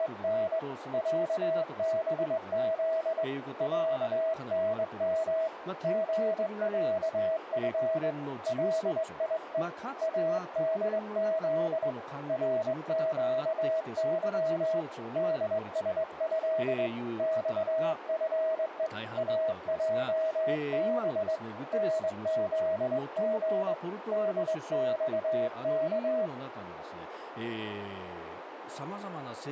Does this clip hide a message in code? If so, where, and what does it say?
Yes: Morse code (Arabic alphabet) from 0.0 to 26.3 s, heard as a keyed tone, hand-sent with a straight key, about 21 wpm, 640 Hz, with radio static, a narrow filter and speech in Japanese. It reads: … عبذ عنم غعف ليء ادذ رقظ دسه صفء اجب نذغ دصك